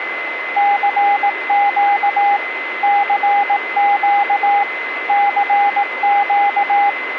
Morse code, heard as a keyed tone, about 18 wpm, 810 Hz, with radio static and a steady whistle near 2050 Hz. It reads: CQ CQ CQ